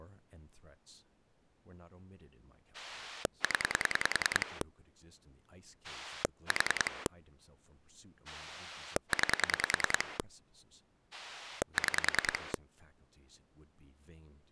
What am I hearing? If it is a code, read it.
Pulse dialling, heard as a rotary dial, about 10 pulses a second, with speech in English. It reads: 0 4 9 6